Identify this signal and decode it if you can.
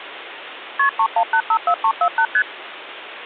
Multi-frequency trunk signalling (R1, as on North American trunks), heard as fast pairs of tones, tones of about 70 ms, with phone line noise. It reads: KP 31854348 ST